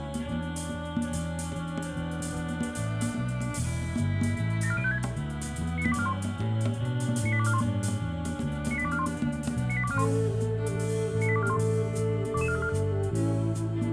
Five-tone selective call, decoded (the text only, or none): 74056 98241 98241 98241 98241 98241 22434